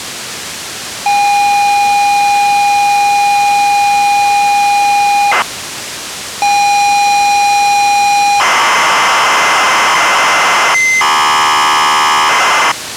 ZX Spectrum tape loading, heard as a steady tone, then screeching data, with tape hiss.